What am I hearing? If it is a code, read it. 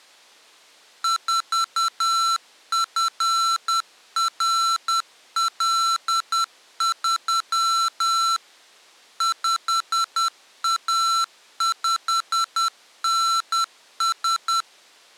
Morse code, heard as electronic beeps, machine-sent, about 10 wpm, 1340 Hz. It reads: 4FRL3 5A5NS